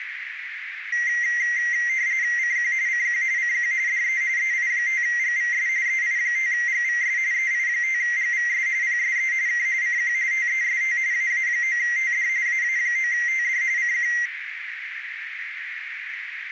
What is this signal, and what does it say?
RTTY (45.45 baud, 170 Hz shift), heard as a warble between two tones, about 2000 Hz centre, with radio static and a narrow filter. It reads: CQ CQ CQ DE EI5GVS EI5GVS EI5GVS PSE K CQ TEST AA9TD AA9TD CQ